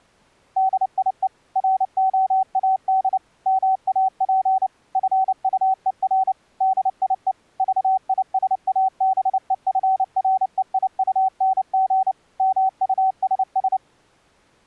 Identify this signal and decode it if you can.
Morse code, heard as a keyed tone, machine-sent, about 29 wpm, 760 Hz. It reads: DIE ROAD MAP FUER DIE VISABEFREIUNG MUSS